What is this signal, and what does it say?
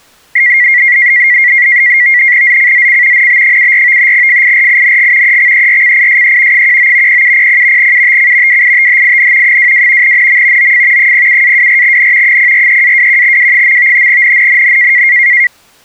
NAVTEX (SITOR-B), 100 baud, 170 Hz shift, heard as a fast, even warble, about 2050 Hz centre. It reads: ZCZC NB74 FIRING EXERCISE 19 0700 UTC WITHIN 22 NM OF 07-24N 043-21W. NNNN